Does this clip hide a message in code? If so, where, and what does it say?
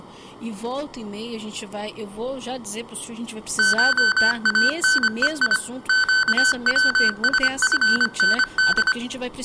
Yes: Morse code (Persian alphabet) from 3.5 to 9.0 s, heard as electronic beeps, machine-sent, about 25 wpm, 1500 Hz. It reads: شانهی گوسفند